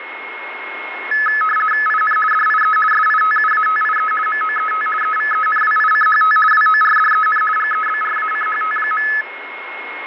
RTTY (50 baud, 450 Hz shift), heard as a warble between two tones, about 1500 Hz centre, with radio static and a steady whistle near 2160 Hz. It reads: IN DIE SITUATIE MOET EVENWICHT WORDEN GEBRACHT.